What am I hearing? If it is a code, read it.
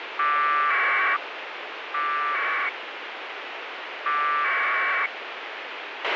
Packet radio (AX.25, as in APRS), 1200 baud, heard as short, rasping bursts, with radio hiss and a squelch burst at the end.